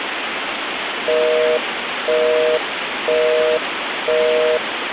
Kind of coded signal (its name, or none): telephone call progress tone